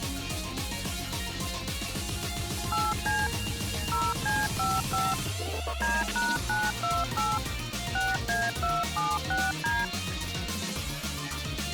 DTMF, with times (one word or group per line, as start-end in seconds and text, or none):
2.7-3.3 8C
3.9-5.1 0C55
5.8-7.4 D#928
8.0-9.8 6A276D